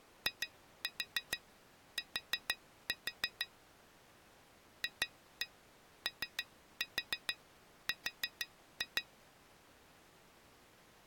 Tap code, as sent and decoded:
2-4 4-4 / 2-1 3-4 4-2
IT FOR

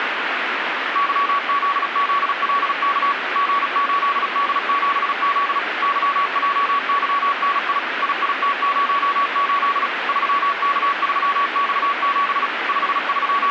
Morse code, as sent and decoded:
-.-- --.. --.. .-.. -.- / --. ---.. -.. --... --.. / -.-- .--- -.-- -. .. / .. .. - ----- ---.. / ...-- -.- ...-- -..- --... / …
YZZLK G8D7Z YJYNI IIT08 3K3X7 …

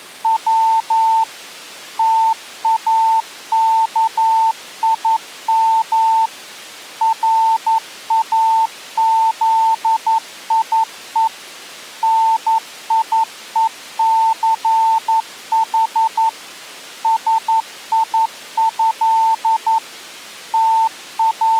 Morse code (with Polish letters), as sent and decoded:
.-- / - .- -.- .. -- / .-. .- --.. .. . / -. .. . -.-. .... / ... .. ..-.. / …
W TAKIM RAZIE NIECH SIĘ …

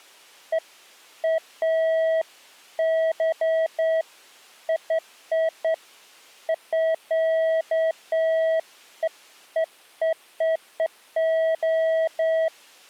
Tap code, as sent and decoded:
none

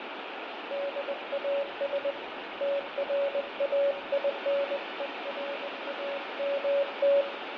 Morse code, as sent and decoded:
-.. .- ... / - .-. .- .. -. . .-. .- -- -
DAS TRAINERAMT

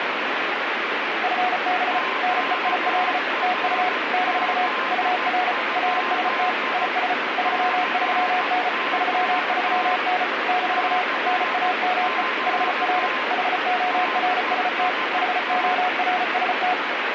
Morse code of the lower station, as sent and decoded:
..-. -... / -. . .. .-.. / - ..- / -....- / ..- .-. / .-. ... - / .. ... / ...-- ...-- -. / ...-- ...-- -. / -....- / -. .- -- . / .... .-. / .... --- .-. ... - / .... --- .-. ... -
FB NEIL TU - UR RST IS 33N 33N - NAME HR HORST HORST

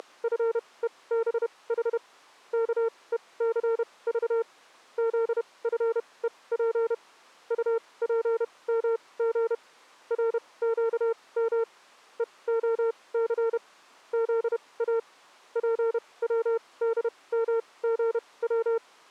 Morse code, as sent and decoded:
… / -.- . -.-. ...- / --.. ..-. . .--. / ..- .--. -- --. / .-. --.- -- / . --- -.-. / --.. .- / .--. .-- -.. -- --. .--
… KECV ZFEP UPMG RQM EOC ZA PWDMGW

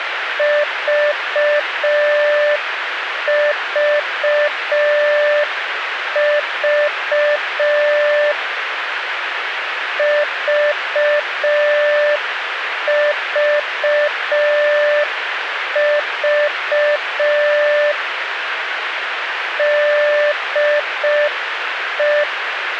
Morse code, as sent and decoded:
...- ...- ...- / ...- ...- ...- / -.. .
VVV VVV DE

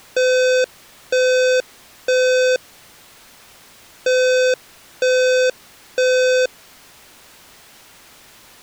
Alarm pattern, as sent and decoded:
3 beeps and a pause
temporal three

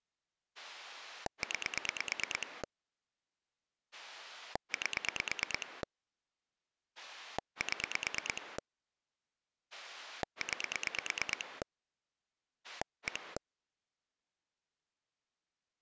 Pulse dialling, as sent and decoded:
9 / 8 / 7 / 9 / 1
9 8 7 9 1

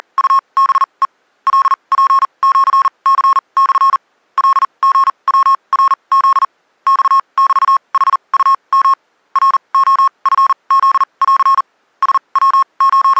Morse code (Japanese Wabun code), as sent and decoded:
… / .-.. .--. --.-. -.-. -..-. / .-.. --. .-- .-. --.. / -..- -...- .... ..- -- / .-. --- ..-. --.. .-.-. / …
… カツシニモ カリヤナフ マメヌウヨ ナレチフン …

